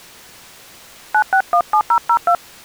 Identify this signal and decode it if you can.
DTMF, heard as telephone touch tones, dialled by hand, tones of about 80 ms. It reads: 9617002